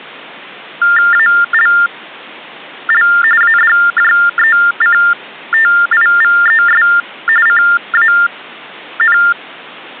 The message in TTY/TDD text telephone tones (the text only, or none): ALL ADJECTIVES CAN